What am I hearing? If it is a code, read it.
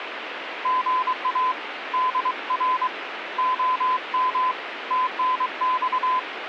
Morse code, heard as a keyed tone, hand-sent with a paddle, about 23 wpm, 1020 Hz, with radio static. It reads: GA DR OM TNX